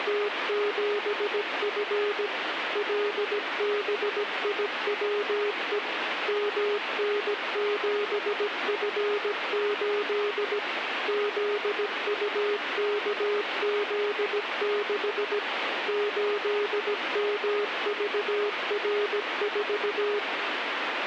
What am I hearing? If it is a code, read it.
Morse code, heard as a keyed tone, machine-sent, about 17 wpm, 410 Hz, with radio static. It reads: … LBIWE MN7F8 ZUKZ6 8MVR4